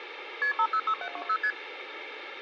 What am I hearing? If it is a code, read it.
Multi-frequency trunk signalling (R1, as on North American trunks), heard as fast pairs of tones, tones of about 70 ms, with phone line noise. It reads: KP 506720 ST